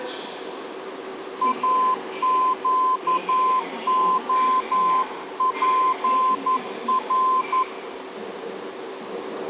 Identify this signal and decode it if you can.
Morse code, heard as a keyed tone, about 11 wpm, 1030 Hz, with the noise of a subway station. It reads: AQOPR